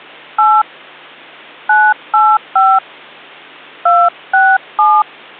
DTMF, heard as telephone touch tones, dialled by hand, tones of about 240 ms. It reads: 8 985 267